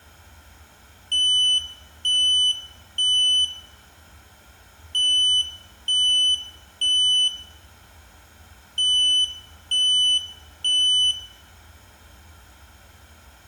Alarm pattern, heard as an alarm's beeps, played three times, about 3000 Hz, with room echo. Temporal three. Smoke or fire, evacuate.